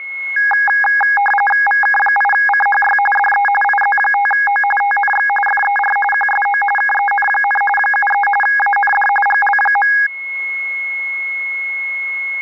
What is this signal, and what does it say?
RTTY (45.45 baud, 850 Hz shift), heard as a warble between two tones, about 1230 Hz centre, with a steady whistle near 2170 Hz. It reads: VK8CHY DE IZ5O TNX FER QSO KEN, 73 AND GL.